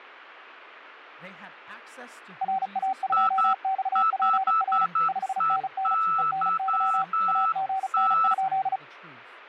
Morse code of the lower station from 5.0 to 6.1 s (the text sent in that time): 5NN